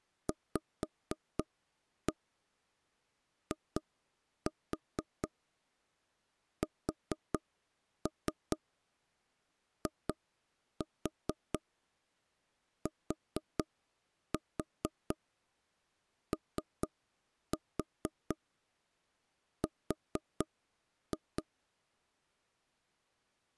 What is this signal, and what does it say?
Tap code, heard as knocks on wood, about 4 knocks a second. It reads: VISITOR